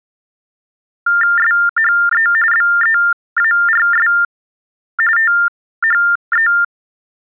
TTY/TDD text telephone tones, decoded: SHE BEARS THE

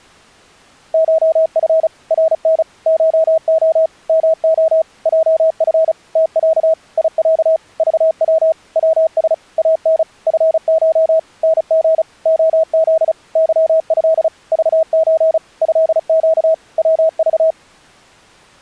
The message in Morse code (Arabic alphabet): شف رن شخ مخ جف تع يع ضو وس ان فش نغ خذ ظه ضز هق وض

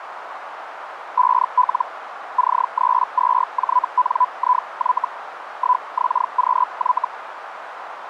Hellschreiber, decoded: 5L C32JNIY 1XQY

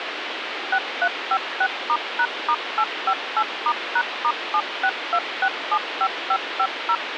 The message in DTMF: 6356*#*858*#*762675550

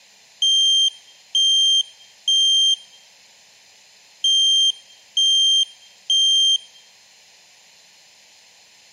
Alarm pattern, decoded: temporal three

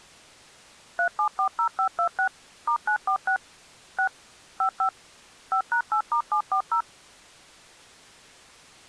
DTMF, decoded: 3740526 *946 6 55 5#8*740

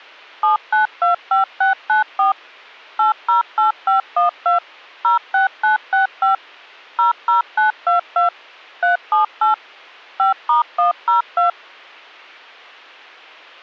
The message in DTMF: 7925694 808512 06965 00922 378 5*102

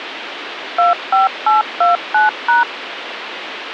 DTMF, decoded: 25829#

